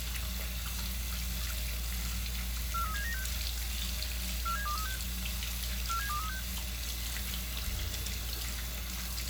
Five-tone selective call (CCIR), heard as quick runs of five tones, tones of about 100 ms, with the noise of a restroom. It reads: 43796 47236 47236